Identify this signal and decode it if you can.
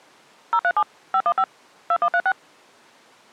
DTMF, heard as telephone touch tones, dialled by machine, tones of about 60 ms. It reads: 037 515 2136